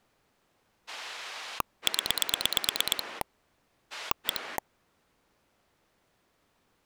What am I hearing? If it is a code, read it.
Pulse dialling, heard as a rotary dial, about 9 pulses a second. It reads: 0 1